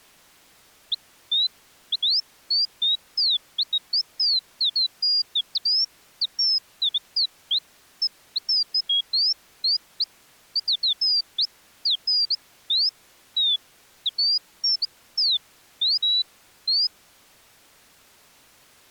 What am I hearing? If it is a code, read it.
Bird-like chirps. There is no code.